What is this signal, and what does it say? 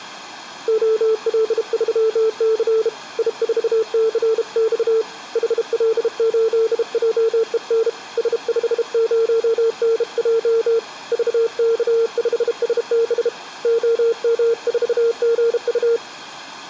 Morse code, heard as a keyed tone, hand-sent with a bug key, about 32 wpm, 450 Hz. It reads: OL3C I4CX HL8JEN S50NJ VK5SB OM4GU